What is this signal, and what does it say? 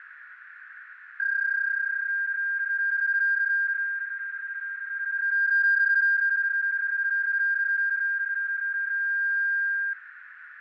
PSK31 (31.25 baud), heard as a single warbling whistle, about 1600 Hz, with radio static, fading and a narrow filter.